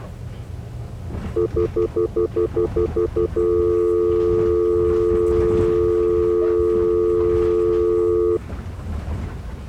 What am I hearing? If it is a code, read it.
Telephone call progress tone (North American plan), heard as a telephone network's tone, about 350, 440 Hz, 0.1 s on and 0.1 s off, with the noise inside a bus. Stutter dial tone.